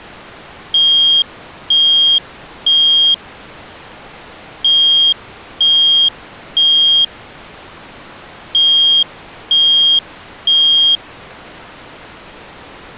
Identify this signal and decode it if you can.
Alarm pattern, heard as an alarm's beeps, played three times, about 3250 Hz. Temporal three. Smoke or fire, evacuate.